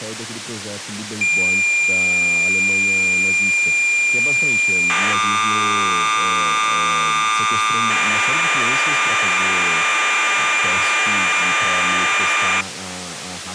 Cassette data (Kansas City type), 1200 baud, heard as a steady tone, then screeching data, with tape hiss and speech in Portuguese.